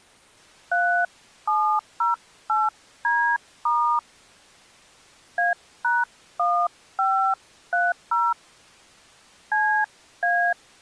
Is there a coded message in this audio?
Yes: DTMF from 0.7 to 10.5 s, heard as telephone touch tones, dialled by hand, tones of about 250 ms. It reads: 3708D* A#1530 CA